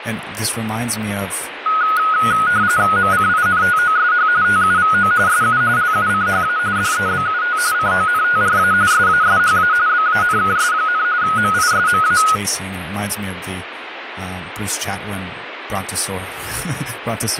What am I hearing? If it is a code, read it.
RTTY (45.45 baud, 170 Hz shift), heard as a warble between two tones, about 1360 Hz centre, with radio static and speech in English. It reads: MCINTOSH TUVO SU LUCHA DEBUT CONTRA SASHA BANKS, MISMA